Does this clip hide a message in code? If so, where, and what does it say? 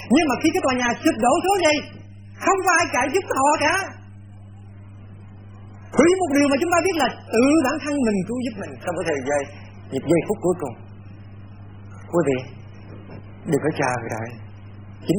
No.